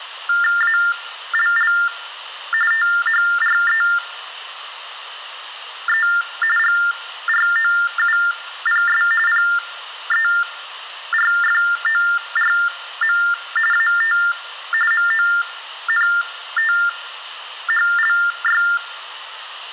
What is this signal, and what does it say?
TTY/TDD text telephone tones (45.45 baud Baudot), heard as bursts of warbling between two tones, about 400 Hz shift, 1600 Hz centre. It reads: ALL THREE GROUPS PERFORM AT MONTHLY